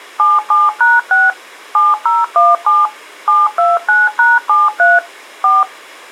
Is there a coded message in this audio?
Yes: DTMF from 0.2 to 5.6 s, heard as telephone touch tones, dialled by machine, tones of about 190 ms. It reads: 77#6 7017 729#73 4